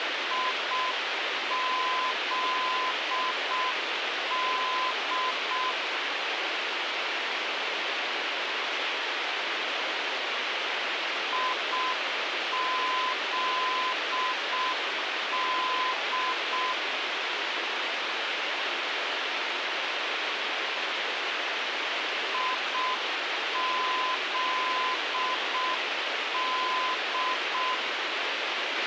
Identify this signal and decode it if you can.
Morse code, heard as a keyed tone, machine-sent, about 6 wpm, 1020 Hz, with radio hiss and a squelch burst at the end. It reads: IZD IZD IZD